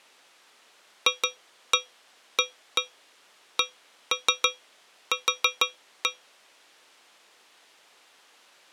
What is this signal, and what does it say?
Tap code, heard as taps on a metal pipe, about 6 knocks a second. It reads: FACQ